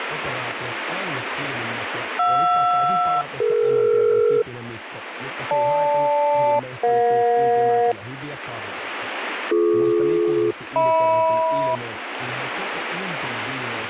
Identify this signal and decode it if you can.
Aircraft SELCAL, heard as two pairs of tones, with radio static and speech in Finnish. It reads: JR-DE GL-EJ BD-HM